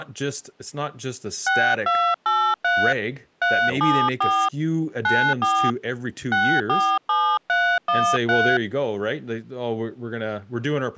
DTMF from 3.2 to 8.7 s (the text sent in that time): 374 94 647313